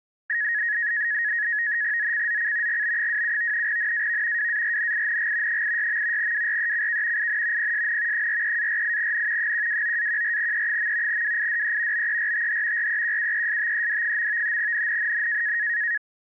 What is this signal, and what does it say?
NAVTEX (SITOR-B), 100 baud, 170 Hz shift, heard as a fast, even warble, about 1800 Hz centre. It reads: ZCZC GB27 NAV WARNING 86. WRECK IN PSN 43-48N 129-14E. WIDE BERTH REQUESTED. NNNN